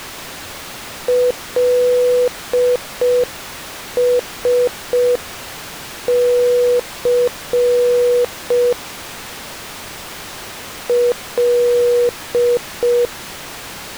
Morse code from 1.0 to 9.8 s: LSC

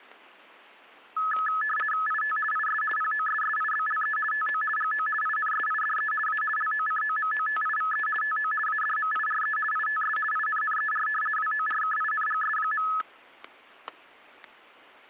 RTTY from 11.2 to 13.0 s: WORKINGS.

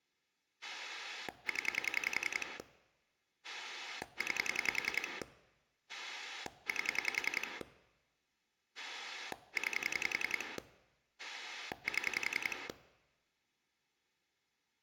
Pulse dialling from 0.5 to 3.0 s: 0

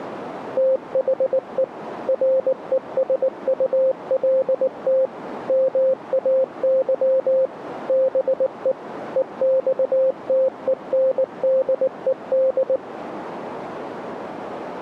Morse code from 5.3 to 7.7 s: MAY

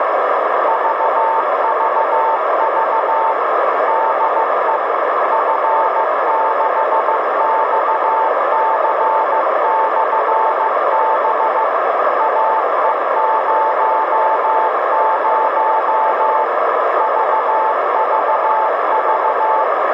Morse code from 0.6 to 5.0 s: VVV DE

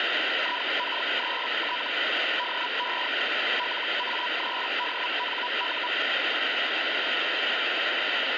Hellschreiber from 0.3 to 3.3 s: IK3T DE

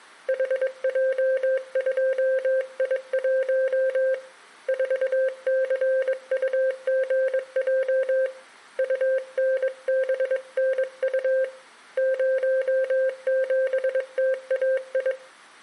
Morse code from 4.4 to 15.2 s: 4CUGJ UNBNU 07TAI

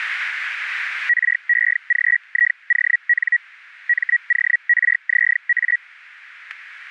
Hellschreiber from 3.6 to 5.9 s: MORZA

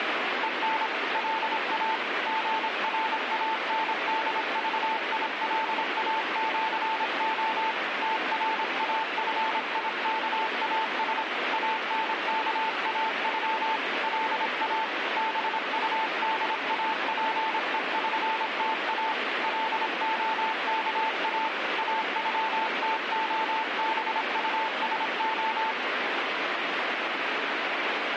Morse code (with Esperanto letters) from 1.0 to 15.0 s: LA GRANDVILAĜO TRAFIKAS ANKAŬ LA

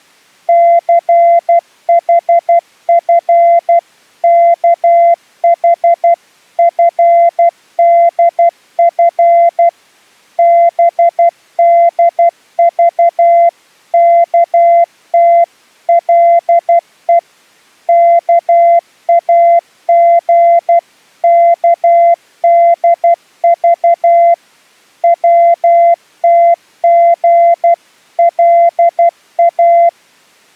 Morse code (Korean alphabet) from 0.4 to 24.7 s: 춘우는 들어가 옷을

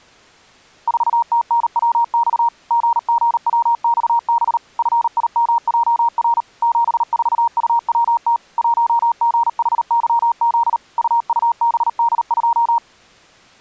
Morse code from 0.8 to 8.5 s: 4TNWX GGWXB FIMJR 74UWT

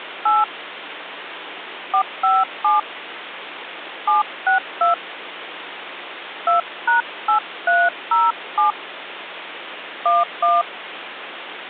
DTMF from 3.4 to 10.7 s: 762 2#8307 11

